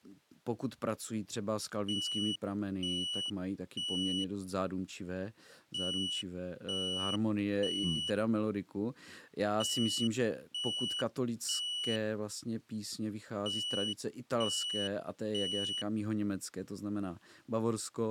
Alarm pattern, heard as an alarm's beeps, played four times, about 2950 Hz, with speech in Czech. Temporal three. Smoke or fire, evacuate.